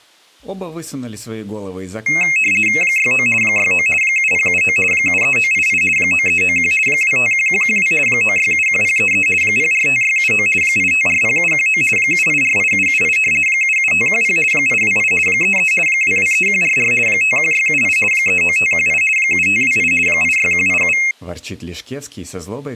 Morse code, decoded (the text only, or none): none